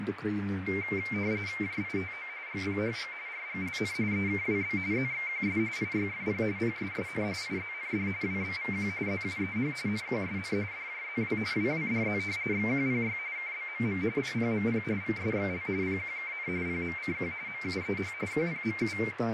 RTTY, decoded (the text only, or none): JITO GPHG RGLN EKWB ZXQS IYFP PSSN IZND WBVQ ZUEH NQSN DJZW WWDZ XQPY KBMM PPMP VSXL PQKN PMCQ MUEH QPMU